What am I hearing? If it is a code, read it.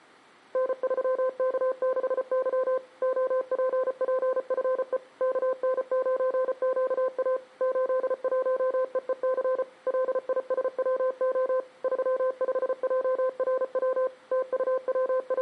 Morse code, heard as a keyed tone, machine-sent, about 34 wpm, 520 Hz. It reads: N3K6Y OPPFE KN9QA 81EEC LISWO 35JRW …